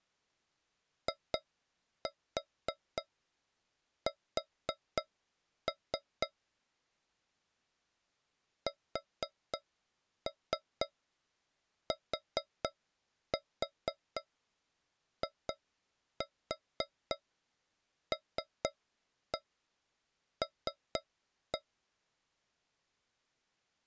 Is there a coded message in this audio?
Yes: tap code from 1.1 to 21.6 s, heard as taps on a metal pipe, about 4 knocks a second. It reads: IS STILL